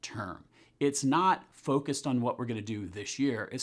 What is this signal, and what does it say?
Speech in English. There is no code.